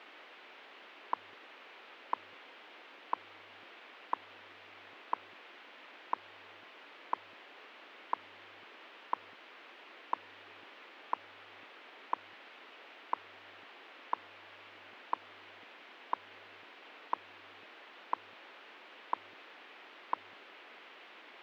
Radio time signal (WWV, Colorado), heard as ticks, one a second, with radio static.